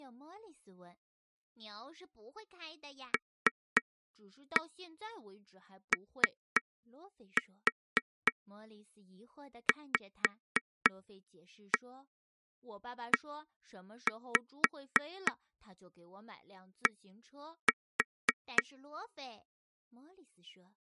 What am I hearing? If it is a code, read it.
Tap code, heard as taps on a table, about 3 knocks a second, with speech in Chinese. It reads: LOVED